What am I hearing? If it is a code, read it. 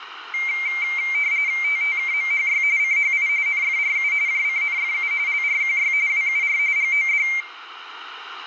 RTTY (45.45 baud, 170 Hz shift), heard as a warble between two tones, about 2200 Hz centre, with radio static and room echo. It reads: TTKMHY CHI NFRU JCNFU LRQY WUR GOD